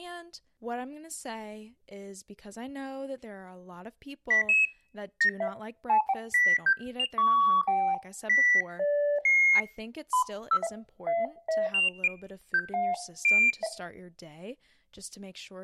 Electronic bleeps of random pitch and length, with speech in English. There is no code.